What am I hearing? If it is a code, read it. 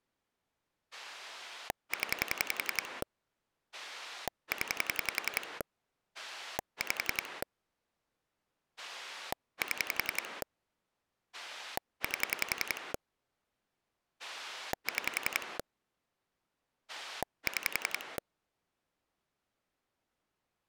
Pulse dialling, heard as a rotary dial, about 11 pulses a second. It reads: 0 0 5 7 8 6 6